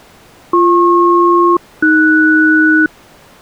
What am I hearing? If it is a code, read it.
Aircraft SELCAL, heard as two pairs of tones. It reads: BP-AS